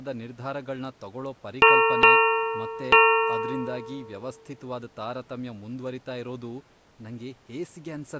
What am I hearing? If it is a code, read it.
Ship's bell, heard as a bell, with speech in Kannada. 3. Three half-hours of the watch have passed.